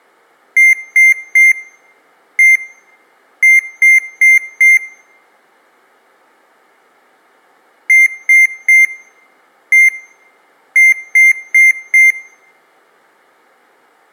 Beep code, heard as beeps from a small speaker, played twice, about 2100 Hz, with room echo. 3-1-4. In Phoenix BIOS tables: interrupt mask register failure.